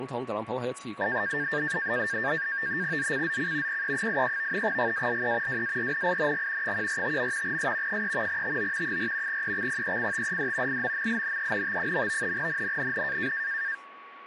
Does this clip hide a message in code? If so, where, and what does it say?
Yes: NAVTEX (SITOR-B), 100 baud, 170 Hz shift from 1.0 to 13.7 s, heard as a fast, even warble, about 1700 Hz centre, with a steady whistle near 1120 Hz. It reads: ZCZC PE83 GALE WARNING 145. S 3 TO 4 EXPECTED IMMINENT. NNNN